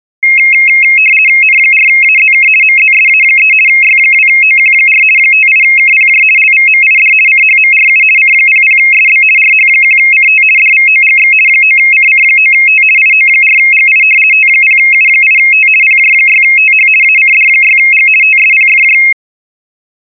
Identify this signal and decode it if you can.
RTTY (50 baud, 450 Hz shift), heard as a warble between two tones, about 2350 Hz centre. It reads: N4AZK MZSA3 Y2OQ4 58KPJ LVMID CHMRU C00SB RH1CT DVOGX 9CC9T IO4GI T0U8T PJ6TH ACD6G TSPFJ